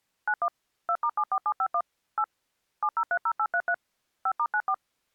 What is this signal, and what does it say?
DTMF, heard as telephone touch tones, dialled by machine, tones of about 60 ms. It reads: 91 2*74751 8 7030833 5*94